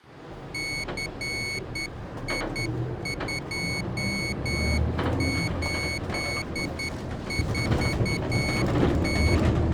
Morse code, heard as a high beeper, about 10 wpm, 2200 Hz, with the noise inside a bus. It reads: CI284T